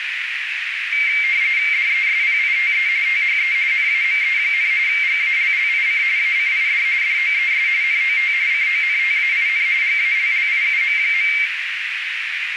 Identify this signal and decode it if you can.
RTTY (45.45 baud, 170 Hz shift), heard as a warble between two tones, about 2200 Hz centre, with radio static and a narrow filter. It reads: DESPITE THE NAME, GALLIC ACID DOES NOT CONTAIN GALLIUM.